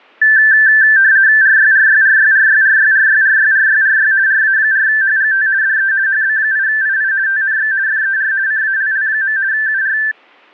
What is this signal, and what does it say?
RTTY (50 baud, 170 Hz shift), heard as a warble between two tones, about 1650 Hz centre. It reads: RYRYRYRYRYRYRYRYRY RA4HGT DE HB8II TNX FER CALL. UR